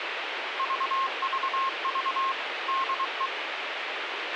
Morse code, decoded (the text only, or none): VVV DE